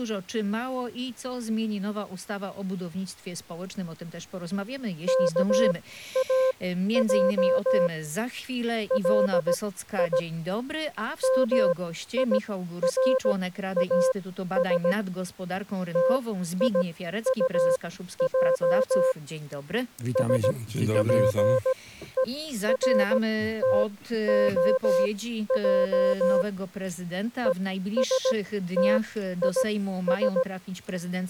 Morse code, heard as a keyed tone, machine-sent, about 17 wpm, spaced as for 12 wpm, 520 Hz. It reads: KAJ LI MIRAS TIUJ SPERTOJ ESTIS